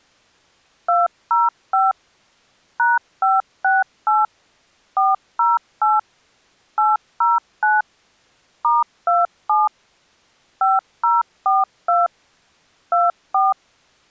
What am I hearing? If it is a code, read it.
DTMF, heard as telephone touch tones, dialled by machine, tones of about 180 ms. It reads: 205 #568 408 809 *27 5042 24